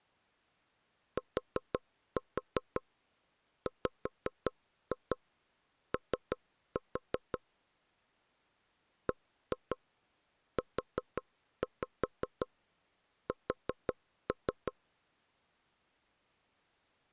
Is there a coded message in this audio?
Yes: tap code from 1.2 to 14.7 s, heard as taps on a table, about 5 knocks a second. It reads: TWO BUS